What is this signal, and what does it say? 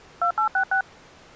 DTMF, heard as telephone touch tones, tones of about 80 ms. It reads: 2866